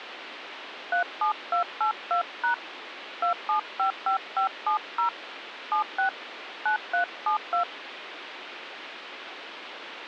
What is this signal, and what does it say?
DTMF, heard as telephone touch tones, dialled by hand, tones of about 110 ms, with phone line noise. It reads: 37282# 2755570 76 9372